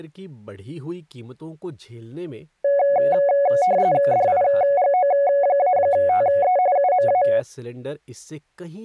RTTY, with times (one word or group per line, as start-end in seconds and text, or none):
4.1-6.6 DIGO-TE
6.8-7.2 UMA